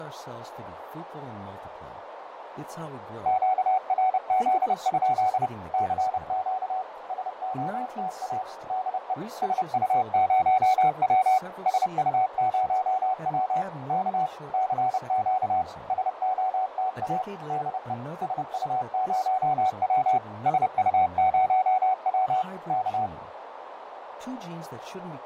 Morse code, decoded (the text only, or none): QRZ? CQ SOTA DE SU0W SU0W K CQ SOTA DE SU0W SU0W K